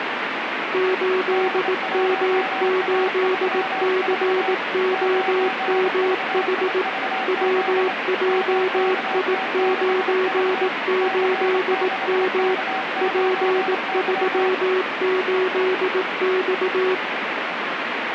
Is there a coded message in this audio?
Yes: Morse code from 0.7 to 17.0 s, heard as two keyed tones, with radio static. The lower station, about 18 wpm, 370 Hz: 8M8COMH WJI98M P38X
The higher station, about 25 wpm, 760 Hz: D1A34 9VIVZ MKT6V C6K9Y